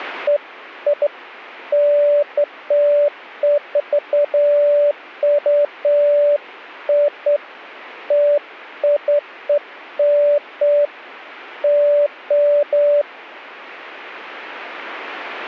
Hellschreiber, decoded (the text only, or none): none